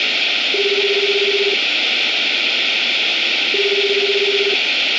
Telephone call progress tone (Japanese plan), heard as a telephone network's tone, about 380, 400, 420 Hz, 1 s on and 2 s off, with phone line noise and room echo. Ringback tone.